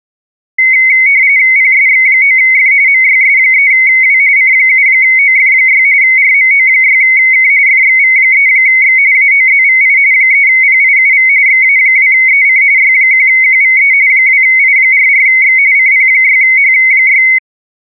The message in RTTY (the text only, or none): PSX9F MYS3W C7OF6 RMO6K FXV3X AOZVI 3PIUV XA2EC Y1QVE 2I44X CP6H6